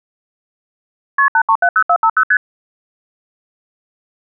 Multi-frequency trunk signalling (R1, as on North American trunks), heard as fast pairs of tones, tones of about 70 ms. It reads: KP 8370450 ST